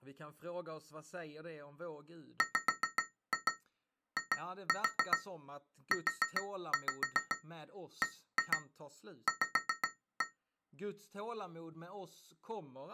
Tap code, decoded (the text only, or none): WIUBV